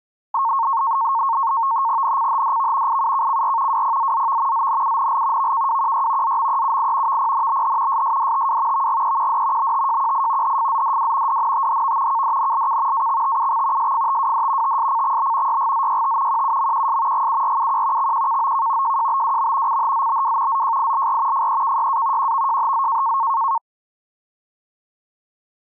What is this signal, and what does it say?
NAVTEX (SITOR-B), 100 baud, 170 Hz shift, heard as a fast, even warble, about 1000 Hz centre. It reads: NCHDV IUKCR WPZZV ZNUNL VKWQY ZMEUI VPNBH SSDTW VGEQD BTJQI HFZDW DNTHV KDNLK AXTUX SFTWD TSCXB YGZYT QUMQS GURUQ XQKOK JJBWM CHZBW ZJILR FEKYA QVJHZ